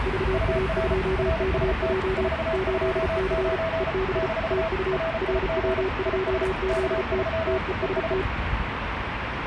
Morse code, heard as two keyed tones, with radio static and street noise. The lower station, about 34 wpm, 380 Hz: VA2KJ 8C EB TU RW2ZT TEST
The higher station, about 34 wpm, 650 Hz: UR RST 429 - RIG IS K3 ES